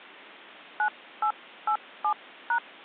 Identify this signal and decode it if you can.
DTMF, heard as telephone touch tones, dialled by hand, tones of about 80 ms. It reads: 9887#